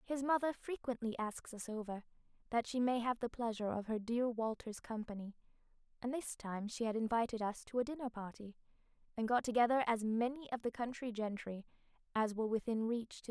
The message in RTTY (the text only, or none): none